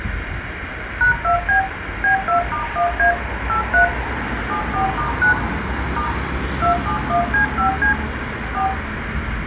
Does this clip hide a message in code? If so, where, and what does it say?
Yes: DTMF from 1.0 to 8.7 s, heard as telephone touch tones, dialled by machine, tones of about 110 ms, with phone line noise, room echo and street noise. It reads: #2B B2*1A 83 74*9 * 271C5C 4